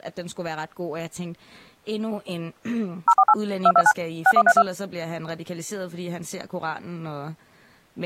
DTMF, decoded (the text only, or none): 048 229 6132